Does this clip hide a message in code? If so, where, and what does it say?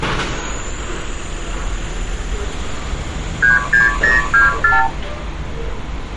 Yes: multi-frequency trunk signalling (R2, with the far end's replies) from 3.4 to 4.9 s, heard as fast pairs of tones, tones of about 150 ms, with street noise. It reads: 36024